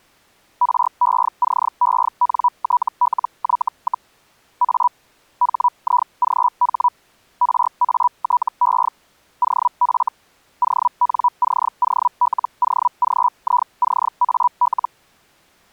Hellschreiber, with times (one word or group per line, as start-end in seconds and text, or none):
0.6-4.1 RECENTLY,
4.6-4.9 A
5.4-6.9 HIGH
7.4-8.9 RATE
9.4-10.1 OF
10.6-14.9 ONCOLOGICAL